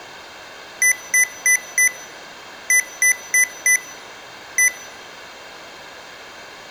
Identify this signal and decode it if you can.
Beep code, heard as beeps from a small speaker, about 2000 Hz. 4-4-1. In Phoenix BIOS tables: serial port failure.